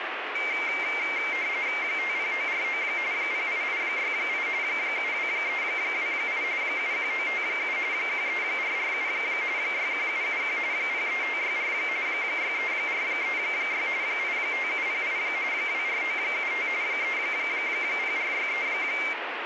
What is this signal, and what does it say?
RTTY (45.45 baud, 170 Hz shift), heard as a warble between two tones, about 2200 Hz centre, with radio static. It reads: 50949 08868 72328 71957 13447 61771 03564 63436 85708 24975 30463